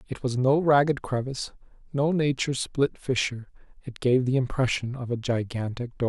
Speech in English. There is no code.